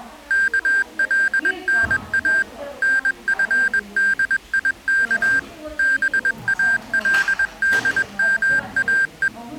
Morse code (Arabic alphabet), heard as electronic beeps, machine-sent, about 21 wpm, 1600 Hz, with the noise of a crowd indoors. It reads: كلنا نفديك بالدماء